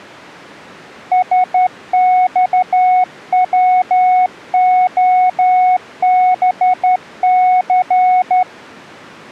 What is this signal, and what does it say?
Morse code, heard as a keyed tone, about 12 wpm, 740 Hz. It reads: SXWOBC